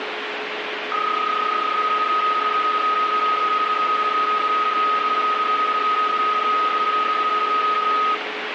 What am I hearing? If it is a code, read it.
PSK31 (31.25 baud), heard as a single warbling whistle, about 1260 Hz, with radio static and a steady whistle near 420 Hz.